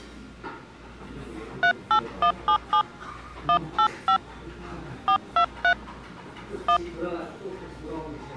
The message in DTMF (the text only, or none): 38177 185 423 1